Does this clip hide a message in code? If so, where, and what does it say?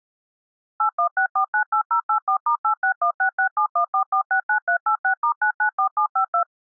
Yes: DTMF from 0.8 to 6.4 s, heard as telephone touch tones, dialled by machine, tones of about 90 ms. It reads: 816498084*86166714469386*994752